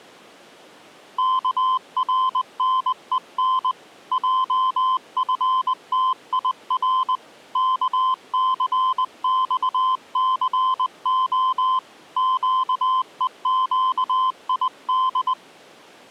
Morse code, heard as a keyed tone, hand-sent with a paddle, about 20 wpm, 1030 Hz. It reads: KRNEN JFTIR KCXCO QEQID